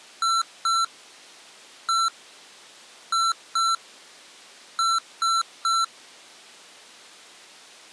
Beep code, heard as beeps from a small speaker, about 1340 Hz. 2-1-2-3. In Phoenix BIOS tables: ROM copyright notice check failure.